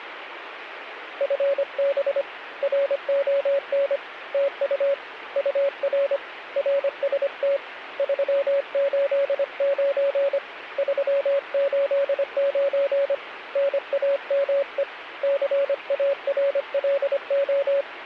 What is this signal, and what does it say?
Morse code, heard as a keyed tone, hand-sent with a paddle, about 25 wpm, 560 Hz, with radio static. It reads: FB RON TU UR RST 389 389 NAME CARLO